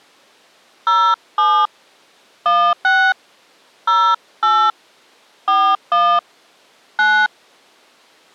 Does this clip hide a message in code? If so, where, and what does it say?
Yes: DTMF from 0.9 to 7.3 s, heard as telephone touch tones, dialled by hand, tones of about 280 ms. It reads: 07 16 08 41 9